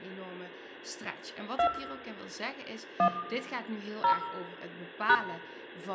DTMF, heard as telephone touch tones, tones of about 100 ms, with room echo and speech in Dutch. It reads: 2 1 0 #